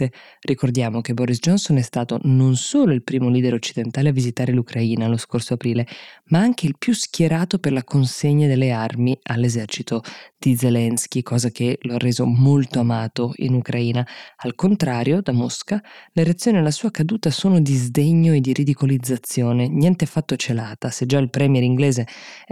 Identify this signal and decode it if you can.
Speech in Italian. There is no code.